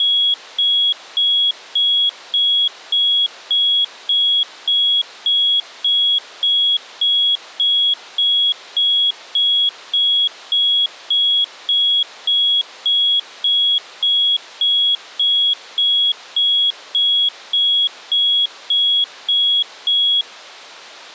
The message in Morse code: none

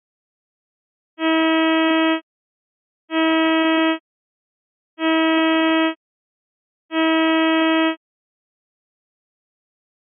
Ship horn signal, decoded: 4 short

